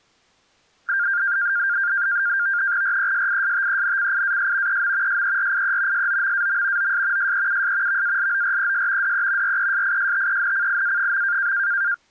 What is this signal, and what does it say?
NAVTEX (SITOR-B), 100 baud, 170 Hz shift, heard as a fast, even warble, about 1500 Hz centre. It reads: RESISTENCIAS EM SERIE SOMAM OS SEUS VALORES DE RESISTENCIA.